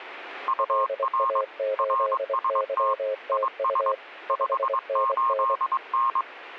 Morse code, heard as two keyed tones. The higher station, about 22 wpm, 1070 Hz: UR RST IS 58N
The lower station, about 24 wpm, 530 Hz: LA8YTU 5NN